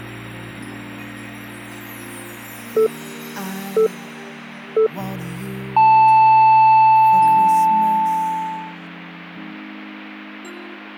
Radio time signal (three low pips and a long one an octave up, as on NHK), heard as pips.